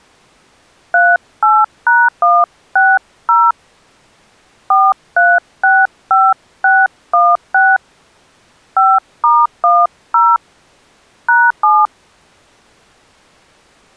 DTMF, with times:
0.9-3.5 38#160
4.7-7.8 4365616
8.8-10.4 5*10
11.3-11.9 #7

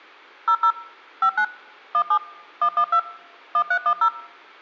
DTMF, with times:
0.5-0.7 00
1.2-1.4 59
1.9-2.2 17
2.6-3.0 112
3.5-4.1 1310

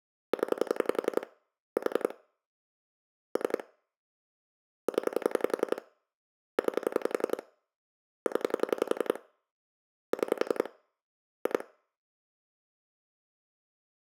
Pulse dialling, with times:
0.3-1.3 0
1.8-2.1 4
3.4-3.6 3
4.9-5.8 0
6.6-7.4 9
8.3-9.2 0
10.1-10.7 6
11.5-11.6 2

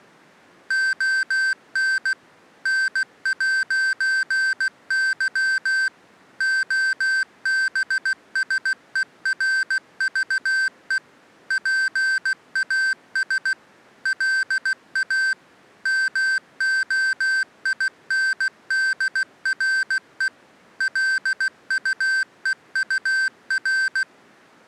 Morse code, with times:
0.7-2.1 ON
2.7-5.9 N'Y
6.4-11.0 OBSERVE
11.5-13.5 PAS
14.1-15.3 LA
15.9-20.3 MOINDRE
20.8-24.0 LUEUR

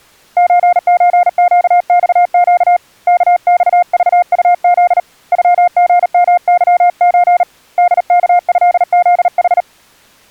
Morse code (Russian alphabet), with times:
0.4-2.8 ЧЧЩЬЩ
3.1-5.0 КЬЖУЗ
5.3-7.4 ЮГМЫЧ
7.8-9.6 ДКЭЗХ

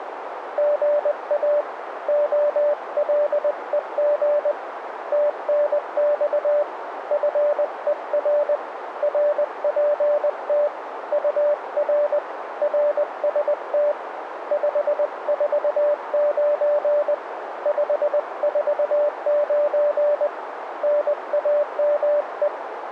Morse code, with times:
0.6-1.6 GA
2.1-4.5 OLEG
5.1-6.6 TNX
7.1-8.6 FER
9.0-10.7 RPT
11.1-12.2 UR
12.6-13.9 RST
14.5-17.1 549
17.7-20.3 549
20.8-22.5 NAME

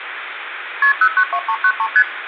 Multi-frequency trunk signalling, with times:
0.8-0.9 KP
1.0-1.9 092393
2.0-2.0 ST

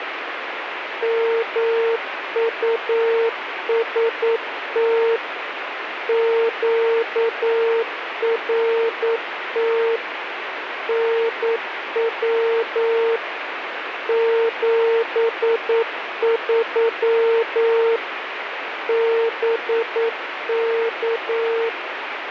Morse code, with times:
1.0-5.2 MUST
6.1-10.0 QRT
10.9-13.2 NW
14.1-18.0 73
18.9-21.7 BK

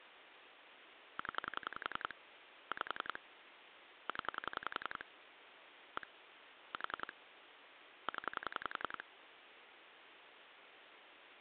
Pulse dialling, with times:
1.2-2.1 0
2.7-3.2 5
4.1-5.0 0
6.0-6.1 1
6.7-7.1 4
8.1-9.0 0

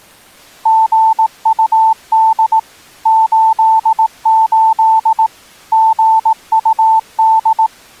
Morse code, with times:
0.7-2.6 GUD
3.1-5.3 88
5.7-7.7 GUD

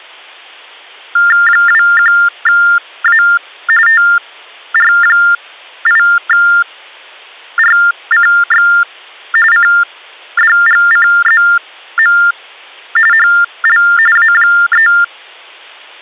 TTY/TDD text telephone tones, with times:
1.5-3.2 21A
3.9-8.7 TR8RCX
9.5-12.2 CDGCZM
13.1-13.8 HL
14.2-14.9 A3

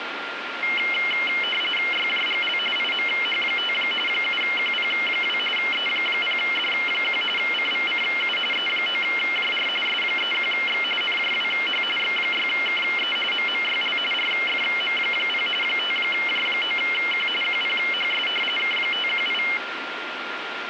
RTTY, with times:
1.9-2.6 YJGL
2.8-3.7 IMH5
4.1-5.4 7QP2
5.6-7.2 E0D1
7.4-8.4 CVCU
8.5-9.7 E9JR
9.9-10.8 S31X
11.0-11.8 NJWH
12.0-13.2 X6KE
13.3-14.0 MMYL
14.1-15.5 RFM0
15.6-17.3 5J9Q
17.4-18.3 QPHS
18.6-19.4 K518

